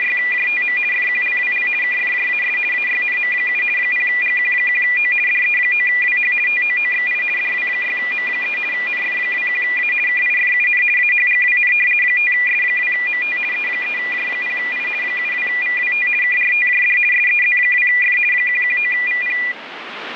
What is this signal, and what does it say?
RTTY (50 baud, 450 Hz shift), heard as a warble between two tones, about 2200 Hz centre, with radio static. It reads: … FQLWL KFJAS AYNM7 0GQ1O DE9WH TOOXI DW6M3 NF21A KIFUN AHGWN 5S2MT E3J0I 72VWT KRTJD SEZ2F 119VP